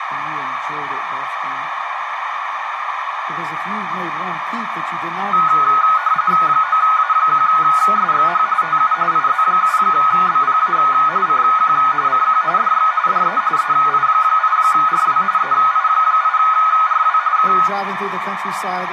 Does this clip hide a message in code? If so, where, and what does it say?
Yes: RTTY (45.45 baud, 170 Hz shift) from 5.3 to 17.7 s, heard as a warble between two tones, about 1360 Hz centre, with radio static and a narrow filter. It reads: 9A1SXH TU IZ7BPA CQ CQ DX DE EI8RW EI8RW K